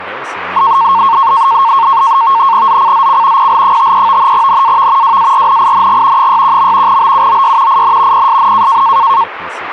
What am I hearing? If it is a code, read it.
NAVTEX (SITOR-B), 100 baud, 170 Hz shift, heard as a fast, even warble, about 1000 Hz centre, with radio static and speech in Russian. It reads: ZCZC PL53 NAV WARNING 61. BUOY IN PSN